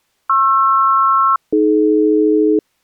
Aircraft SELCAL, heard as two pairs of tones. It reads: PR-AD